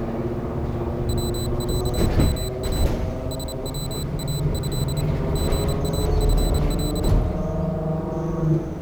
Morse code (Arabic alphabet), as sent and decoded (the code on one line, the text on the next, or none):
.-- .-.- -- .- / ... .-- .- ..-.. / --. .- ..-. .-..
وعما سواه غافل